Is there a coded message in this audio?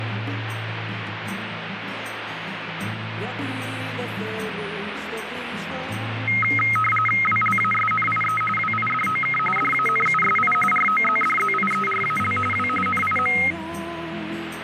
Yes: RTTY (45.45 baud, 850 Hz shift) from 6.3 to 13.5 s, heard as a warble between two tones, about 1700 Hz centre, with radio static. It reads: WLASNIE WIDOK DANUSI ROZDZIERAL W NIM